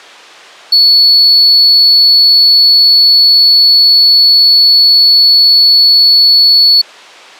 A steady tone. There is no code.